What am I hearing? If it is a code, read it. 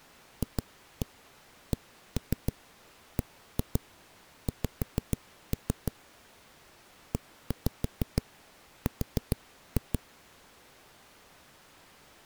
Tap code, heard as knocks on a wall, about 6 knocks a second. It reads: FCBX ER